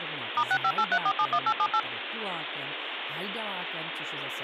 DTMF, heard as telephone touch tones, dialled by machine, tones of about 60 ms, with phone line noise and speech in Czech. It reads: *6583471878